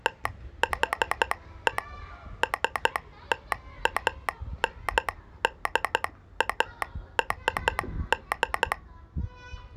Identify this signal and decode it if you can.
Morse code (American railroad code), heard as a telegraph sounder, hand-sent with a straight key, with the noise of a residential street. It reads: THE STANDARD